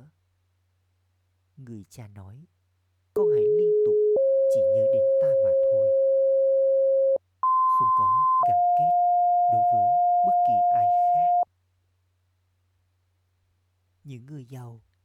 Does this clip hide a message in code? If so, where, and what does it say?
Yes: two-tone page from 3.2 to 11.4 s, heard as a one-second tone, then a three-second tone, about 420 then 540 Hz, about 1040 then 710 Hz, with speech in Vietnamese.